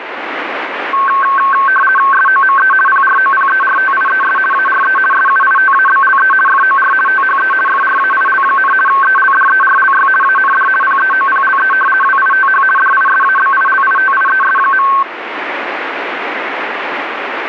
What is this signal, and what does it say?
RTTY (50 baud, 450 Hz shift), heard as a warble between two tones, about 1320 Hz centre, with radio static. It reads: SOME PROPERTIES ARE SUITABLE FOR THE FRAIL, ELDERLY AND PEOPLE WITH DISABILITIES.